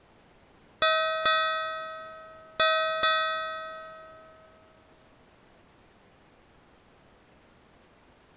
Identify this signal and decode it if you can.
Ship's bell, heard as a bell. 4. Four half-hours of the watch have passed.